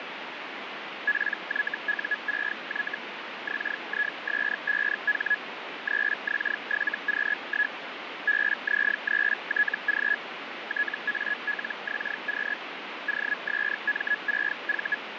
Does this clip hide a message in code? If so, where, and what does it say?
Yes: Hellschreiber (Feld-Hell, 122.5 baud) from 1.1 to 15.0 s, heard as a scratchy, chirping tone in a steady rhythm, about 1700 Hz, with radio static. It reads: PYU6Y XIS5H 3X7Q1 BZ3TG TALXQ OSM6V